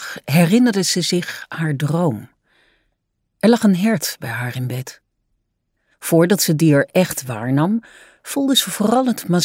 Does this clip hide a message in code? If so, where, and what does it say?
No.